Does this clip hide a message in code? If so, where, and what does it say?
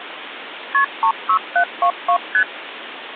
Yes: multi-frequency trunk signalling (R1, as on North American trunks) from 0.7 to 2.4 s, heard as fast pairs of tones, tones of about 80 ms, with phone line noise. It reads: KP 36722 ST